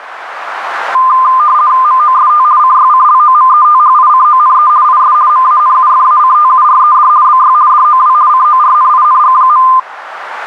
RTTY (50 baud, 170 Hz shift), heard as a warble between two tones, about 1120 Hz centre, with radio static. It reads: MOST CYCLOMETHICONE IS MANUFACTURED BY DOW CORNING.